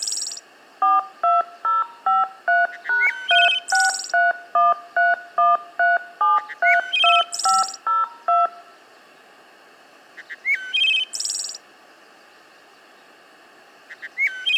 DTMF, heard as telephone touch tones, dialled by machine, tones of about 180 ms. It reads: 42053#3631313732502